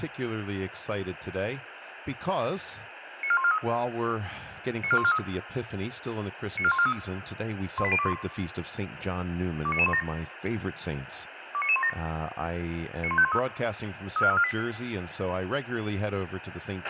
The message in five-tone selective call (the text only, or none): 94143 94143 94143 18021 29917 29917 91513 34348